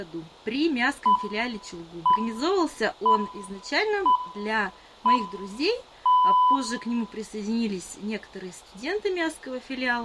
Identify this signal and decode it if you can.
Radio time signal (six pips, as the Greenwich Time Signal), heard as pips, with room echo.